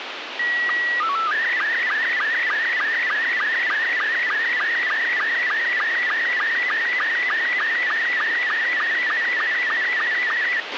SSTV (slow-scan television), Robot 72, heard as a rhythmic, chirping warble, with radio hiss and a squelch burst at the end.